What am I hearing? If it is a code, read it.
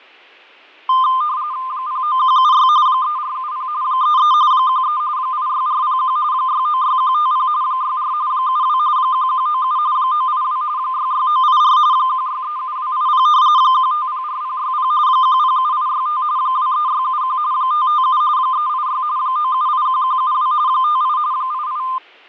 RTTY (45.45 baud, 170 Hz shift), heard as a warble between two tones, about 1120 Hz centre, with fading. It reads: 09176 3470 33 13 86401 696150 64 72 1197 982 66984 1637280 1504060 107865 23671 557 386 9781172 58 88